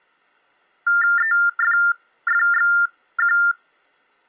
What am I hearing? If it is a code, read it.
TTY/TDD text telephone tones (45.45 baud Baudot), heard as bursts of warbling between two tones, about 400 Hz shift, 1600 Hz centre. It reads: EFFXQ